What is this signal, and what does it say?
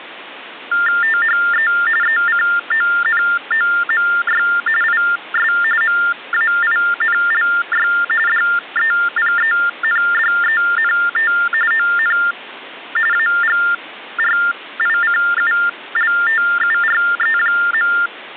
TTY/TDD text telephone tones (45.45 baud Baudot), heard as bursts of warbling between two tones, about 400 Hz shift, 1600 Hz centre. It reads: THE ECONOMY IS MAINLY DEPENDENT ON AGRICULTURE.